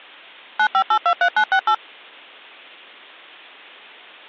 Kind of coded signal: DTMF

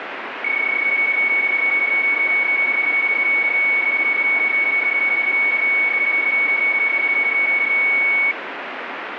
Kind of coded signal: PSK31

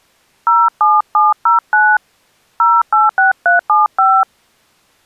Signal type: DTMF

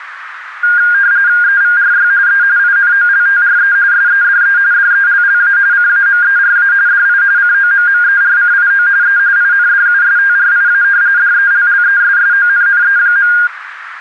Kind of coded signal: RTTY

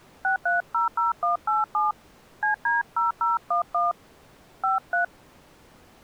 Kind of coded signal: DTMF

